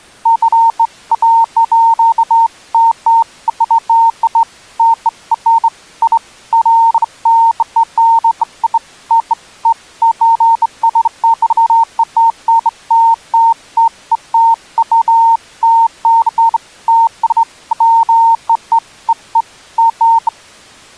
Beeps of irregular length. There is no code.